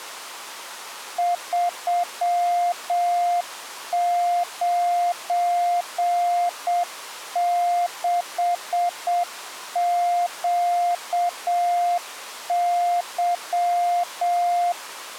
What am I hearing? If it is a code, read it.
Morse code, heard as a keyed tone, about 7 wpm, 700 Hz. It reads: 396QY